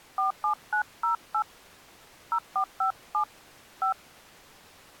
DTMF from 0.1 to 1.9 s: 47908

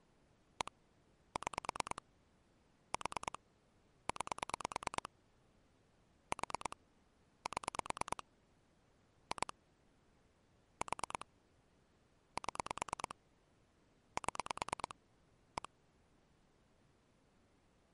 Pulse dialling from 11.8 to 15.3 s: 7 7

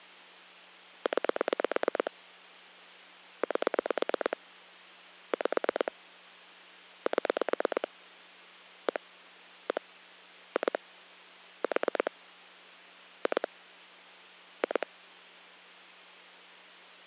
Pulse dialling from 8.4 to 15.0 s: 1 1 2 4 2 2

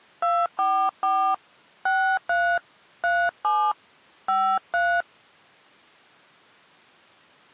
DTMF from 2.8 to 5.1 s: 37 53

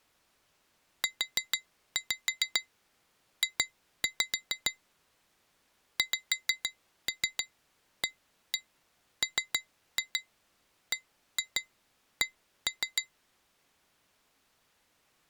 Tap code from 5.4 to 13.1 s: XAMBC

